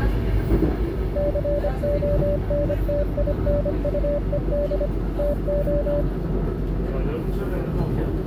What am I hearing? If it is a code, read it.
Morse code, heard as a keyed tone, machine-sent, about 25 wpm, 580 Hz, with the noise inside a subway train. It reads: CONTINUED TO